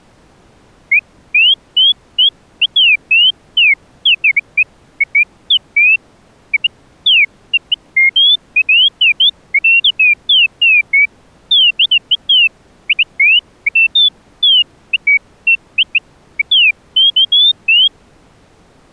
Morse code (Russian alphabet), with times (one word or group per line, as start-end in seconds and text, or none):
none